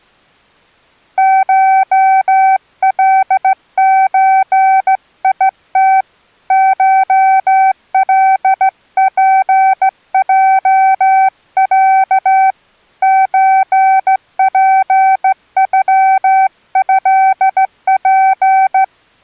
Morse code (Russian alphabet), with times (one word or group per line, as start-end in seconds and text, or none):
1.2-6.0 ШЛЧИТ
6.5-12.5 ШЛПЙЯ
13.0-18.8 ЧПЮЭП